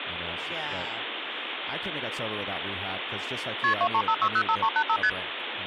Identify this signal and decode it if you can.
Multi-frequency trunk signalling (R1, as on North American trunks), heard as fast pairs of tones, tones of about 70 ms, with phone line noise and speech in English. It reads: KP 235605385 ST